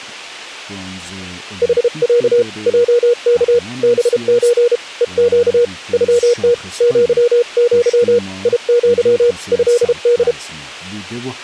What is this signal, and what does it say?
Morse code (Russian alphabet), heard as a keyed tone, hand-sent with a paddle, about 32 wpm, 480 Hz. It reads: ХЯ ЙК БЧ ЕЩ ЮТ ЪЪ ИЪ ЭД